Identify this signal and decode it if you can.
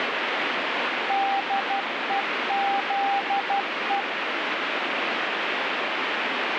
Morse code, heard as a keyed tone, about 12 wpm, 790 Hz, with heavy radio static. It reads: DEZE